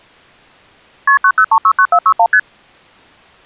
Multi-frequency trunk signalling (R1, as on North American trunks), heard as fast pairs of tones, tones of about 70 ms. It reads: KP 90369461 ST